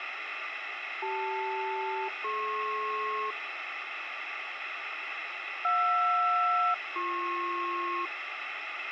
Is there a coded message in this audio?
Yes: aircraft SELCAL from 1.0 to 8.1 s, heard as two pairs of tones, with radio hiss. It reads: CL-DP JR-BP